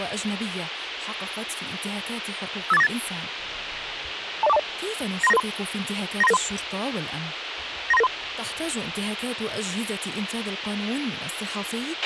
Five-tone selective call (EIA), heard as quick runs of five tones, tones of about 30 ms, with radio hiss and a squelch burst at the end. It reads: 58498 20420 93993 93993 93993